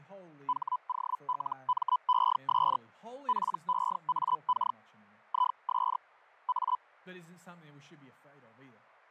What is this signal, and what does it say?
Hellschreiber (Feld-Hell, 122.5 baud), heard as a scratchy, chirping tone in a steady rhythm, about 1000 Hz, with fading and speech in English. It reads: HOLMES PEAK IS A